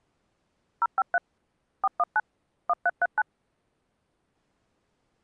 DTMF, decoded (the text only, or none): 053 419 1339